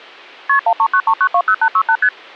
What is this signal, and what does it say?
Multi-frequency trunk signalling (R1, as on North American trunks), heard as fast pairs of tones, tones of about 70 ms. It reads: KP 1393920868 ST